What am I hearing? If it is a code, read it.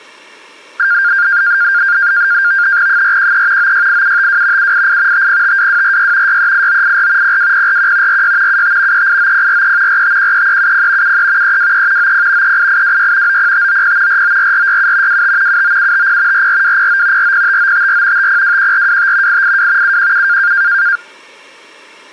NAVTEX (SITOR-B), 100 baud, 170 Hz shift, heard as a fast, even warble, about 1500 Hz centre. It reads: 413 968752 788 5052246 638984 02041 46 75 389043 4513370 73 323 90 38826 90590 494467 25 79750 44209 405954 5021425 882 717